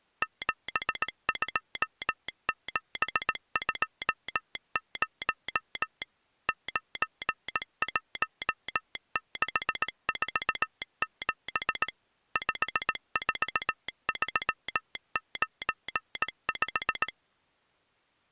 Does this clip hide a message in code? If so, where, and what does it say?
Yes: Morse code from 0.2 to 17.1 s, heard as a telegraph sounder, machine-sent, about 18 wpm. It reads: 72720 91647 54395